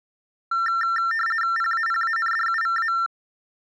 RTTY (50 baud, 450 Hz shift), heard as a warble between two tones, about 1600 Hz centre. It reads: PAPANDUVA